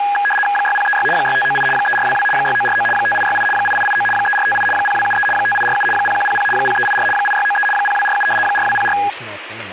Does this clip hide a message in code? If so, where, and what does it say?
Yes: RTTY (75 baud, 850 Hz shift) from 0.0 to 9.1 s, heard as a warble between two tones, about 1240 Hz centre, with radio static and speech in English. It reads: 6036 6598 3422 6949 5868 8889 3458 0273 5847 0100 0384 8693 0247 4204